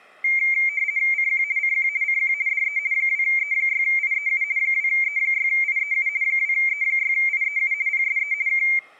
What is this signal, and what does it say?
RTTY (50 baud, 170 Hz shift), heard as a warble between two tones, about 2200 Hz centre. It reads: CQ CQ CQ DE 2E6IEU 2E6IEU 2E6IEU PSE K